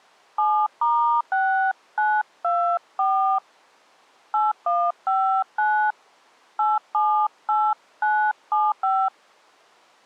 DTMF, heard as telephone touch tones, dialled by hand, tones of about 270 ms. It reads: 7*6924 8159 878975